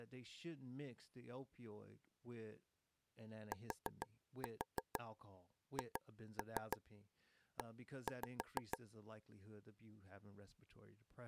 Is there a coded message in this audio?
Yes: tap code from 3.5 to 8.8 s, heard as taps on a table, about 6 knocks a second, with speech in English. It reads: THE